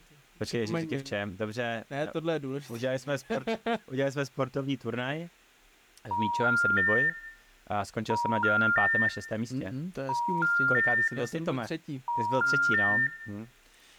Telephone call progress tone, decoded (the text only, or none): special information tone